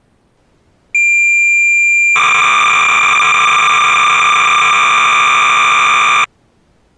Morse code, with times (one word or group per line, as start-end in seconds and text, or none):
none